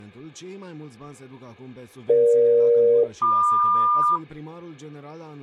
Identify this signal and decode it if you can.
Aircraft SELCAL, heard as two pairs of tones. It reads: EG-MQ